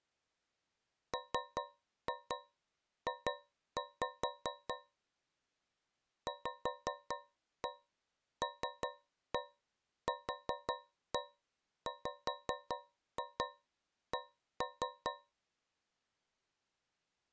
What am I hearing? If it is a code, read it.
Tap code, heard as taps on a metal pipe, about 5 knocks a second. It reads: MJ VLQWC